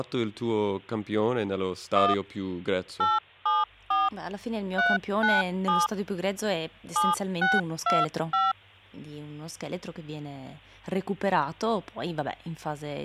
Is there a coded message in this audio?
Yes: DTMF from 2.0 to 8.5 s, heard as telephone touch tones, dialled by hand, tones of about 190 ms, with speech in Italian. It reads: 1 874 397 7625